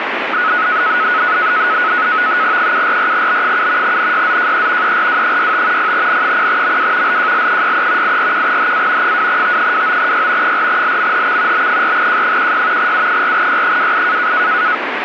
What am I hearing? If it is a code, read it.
NAVTEX (SITOR-B), 100 baud, 170 Hz shift, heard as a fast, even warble, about 1370 Hz centre, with radio static. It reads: 744B7 NYZJE ERW65 0N0MW LJL63 841HA 2T29Y 4LMHX B4J16 U4Y28